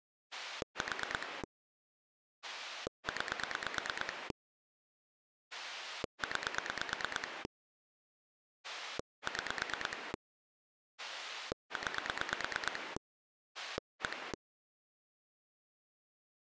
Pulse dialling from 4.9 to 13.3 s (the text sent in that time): 9 6 9